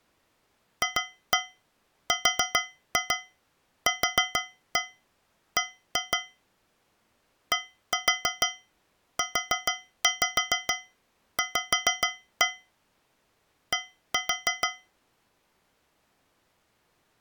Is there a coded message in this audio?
Yes: tap code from 0.8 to 14.9 s, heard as taps on a metal pipe, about 6 knocks a second. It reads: FRQB DUV D